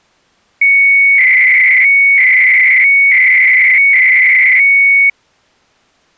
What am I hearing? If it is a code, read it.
300-baud modem data (Bell 103 tones), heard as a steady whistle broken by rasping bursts, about 300 baud, 200 Hz shift.